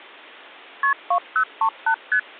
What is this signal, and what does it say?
Multi-frequency trunk signalling (R1, as on North American trunks), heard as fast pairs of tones, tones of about 80 ms. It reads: KP 2038 ST